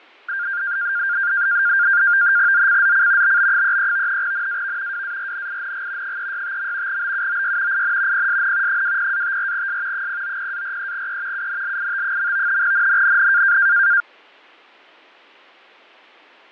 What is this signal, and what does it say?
NAVTEX (SITOR-B), 100 baud, 170 Hz shift, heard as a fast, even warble, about 1500 Hz centre, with fading. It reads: ZCZC BB33 NAV WARNING 365. BUOY IN PSN 20-54S 090-43E UNLIT. NNNN